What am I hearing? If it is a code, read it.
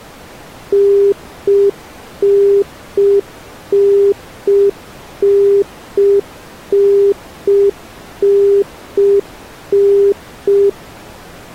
Telephone call progress tone (UK plan), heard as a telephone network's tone, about 400 Hz. Congestion tone.